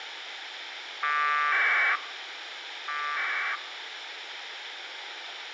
Packet radio (AX.25, as in APRS), 1200 baud, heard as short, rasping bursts, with radio hiss.